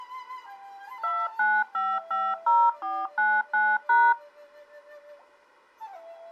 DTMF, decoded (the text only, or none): 29550499#